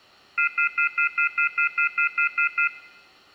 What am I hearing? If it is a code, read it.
Telephone call progress tone (North American plan), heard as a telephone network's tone, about 1400, 2050, 2450, 2600 Hz, 0.1 s on and 0.1 s off, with room echo. Off-hook warning tone.